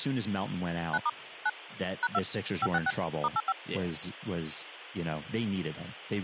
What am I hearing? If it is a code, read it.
DTMF, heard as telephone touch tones, dialled by machine, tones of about 40 ms, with speech in English. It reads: 9* 9 #2 566 *85